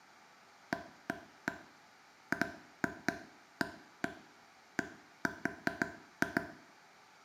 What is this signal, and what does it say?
Irregular taps on a table, with room echo. There is no code.